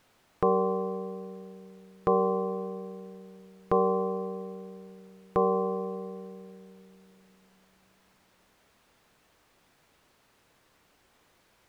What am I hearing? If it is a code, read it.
Clock strike, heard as a bell. 4. Four o'clock.